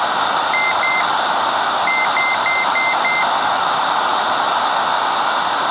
Beep code, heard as beeps from a small speaker, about 2100 Hz, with room echo. 2-5.